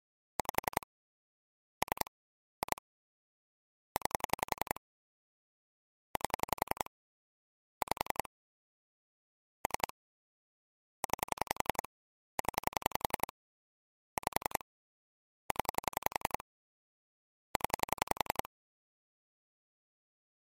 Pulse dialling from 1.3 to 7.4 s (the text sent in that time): 3 2 9 8